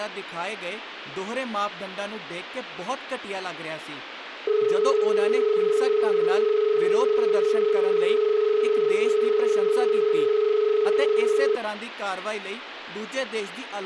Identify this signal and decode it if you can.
Telephone call progress tone (as in Australia), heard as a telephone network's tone, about 430 Hz, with phone line noise and speech in Punjabi. Dial tone.